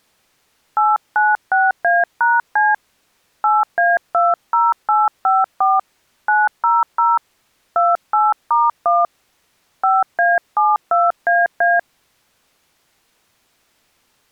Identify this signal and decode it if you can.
DTMF, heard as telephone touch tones, dialled by hand, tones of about 190 ms. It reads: 896A#C 8A20854 900 28*1 5A72AA